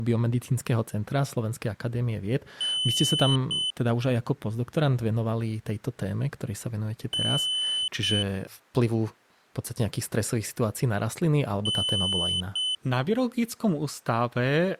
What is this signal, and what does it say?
Beep code, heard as a piezo beeper, played three times, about 3000 Hz, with speech in Slovak. 1 long, 1 short. In IBM BIOS tables: system board problem.